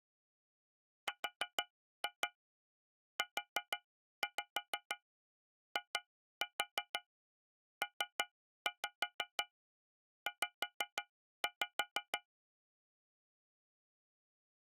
Tap code, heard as taps on a metal pipe, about 6 knocks a second. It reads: RUIPZ